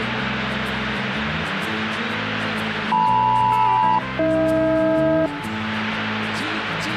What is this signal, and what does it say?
Aircraft SELCAL, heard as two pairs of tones, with radio static. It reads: LM-AH